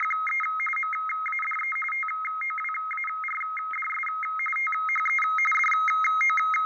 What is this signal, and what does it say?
RTTY (45.45 baud, 850 Hz shift), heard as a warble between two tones, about 1700 Hz centre, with fading and room echo. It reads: … MADE TOWARDS THE …